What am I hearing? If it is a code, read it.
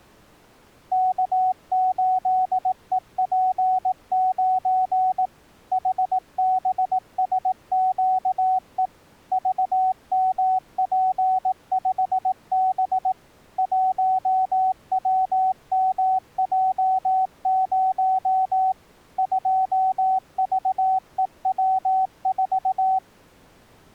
Morse code, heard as a keyed tone, machine-sent, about 18 wpm, 750 Hz. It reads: K8EP9 HBSQE VMP5B 1WMJ0 2VEW4